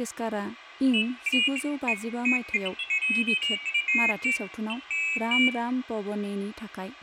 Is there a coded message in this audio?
No, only pairs of high tones at irregular times, with room echo and speech in Bodo.